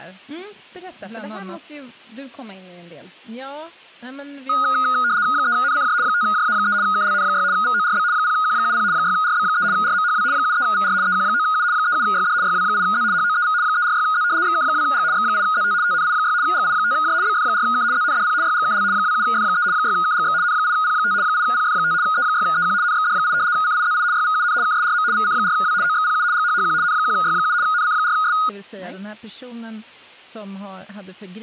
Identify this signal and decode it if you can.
RTTY (75 baud, 170 Hz shift), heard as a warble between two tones, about 1350 Hz centre, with speech in Swedish. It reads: 3NCJ 5JA3 KLN6 VORB 0Q70 6RB3 RMHW 73VR EQ9U 37YD YW8Z HOEV 346Z XK2G X8ZT TNI6 GI5J BF4K ZNDP YGKL 27F3 6KGX N8P5 8PF5 E6EQ NXD8 CIZI YVUN KSRM VC4W OXPU GHHQ N1Y7 NC4S